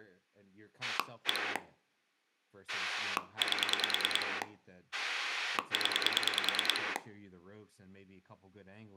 Pulse dialling, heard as a rotary dial, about 10 pulses a second, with room echo and speech in English. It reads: 1 8 0